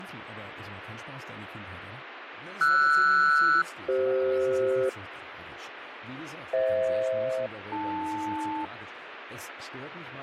Aircraft SELCAL, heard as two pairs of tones, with radio static, fading and speech in German. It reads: RS-CF FH-AL